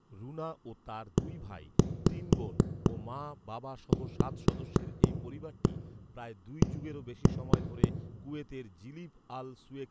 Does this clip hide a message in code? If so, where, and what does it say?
Yes: tap code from 1.2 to 7.9 s, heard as knocks on a wall, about 4 knocks a second, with room echo and speech in Bangla. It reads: EVC